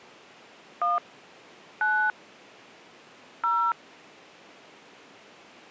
DTMF, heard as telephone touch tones, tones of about 210 ms. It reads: 1 9 0